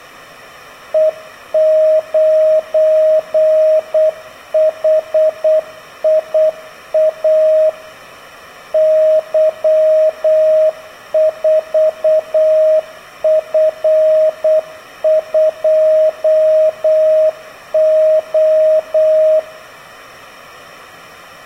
Morse code, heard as a keyed tone, machine-sent, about 8 wpm, 630 Hz, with room echo. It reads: E9HIA Y4F2O